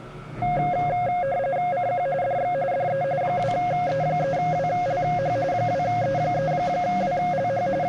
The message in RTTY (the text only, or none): CQ DX DE 2E3WLH 2E3WLH …